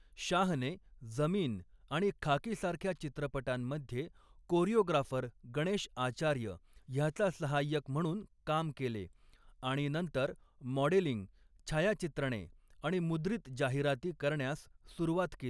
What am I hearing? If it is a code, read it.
Speech in Marathi. There is no code.